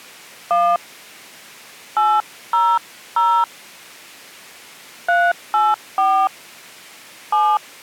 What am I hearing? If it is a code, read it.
DTMF, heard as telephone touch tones, dialled by hand, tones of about 240 ms. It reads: 1 800 384 7